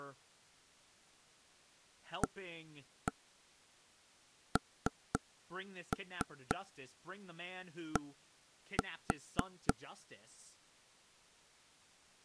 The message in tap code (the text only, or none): AND